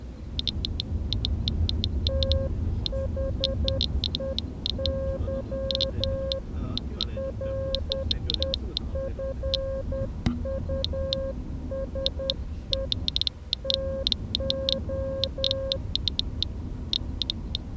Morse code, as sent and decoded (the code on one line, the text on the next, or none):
- .... . -.-- / .-. . ..-. ..- ... . / - ---
THEY REFUSE TO